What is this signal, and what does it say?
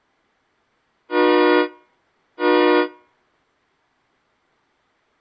Train horn signal, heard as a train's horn. 2 short. On North American railways: a signal is acknowledged.